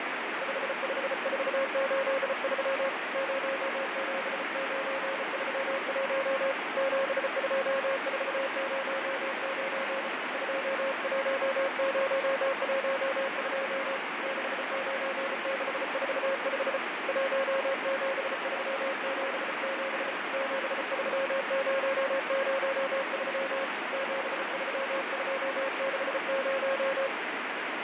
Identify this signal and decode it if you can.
Morse code, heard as a keyed tone, hand-sent with a bug key, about 34 wpm, 540 Hz, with heavy radio static. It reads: 55483 07931 72409 21012 69645 17377 73003 73260